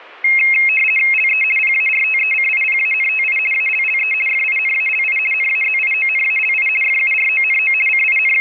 RTTY (50 baud, 450 Hz shift), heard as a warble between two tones, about 2350 Hz centre. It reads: LE PARTECIPANTI ALLE FINALI NAZIONALI FURONO …